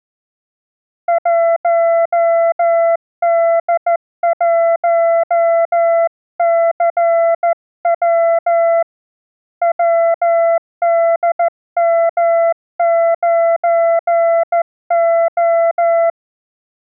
Morse code, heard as a keyed tone, hand-sent with a straight key, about 14 wpm, 670 Hz. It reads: 1D1CW WDM9O